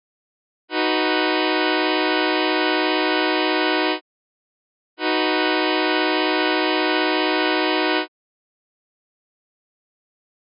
Train horn signal, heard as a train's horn. 2 long. On North American railways: brakes released, proceed.